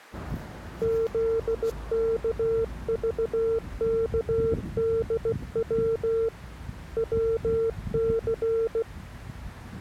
Morse code, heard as a keyed tone, hand-sent with a paddle, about 16 wpm, 450 Hz, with street noise. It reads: ZKVKDW WC